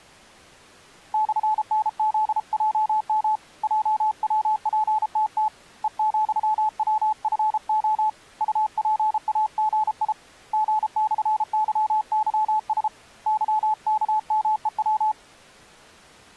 Morse code, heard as a keyed tone, hand-sent with a paddle, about 33 wpm, 860 Hz. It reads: /NZJM JWPTT E,WFO UPAGI G/YYS YKMEW